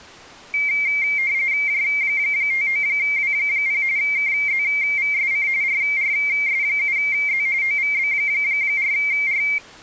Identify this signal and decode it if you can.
RTTY (45.45 baud, 170 Hz shift), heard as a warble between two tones, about 2200 Hz centre. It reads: J59W0 KZVSC RRS7Z OVB4R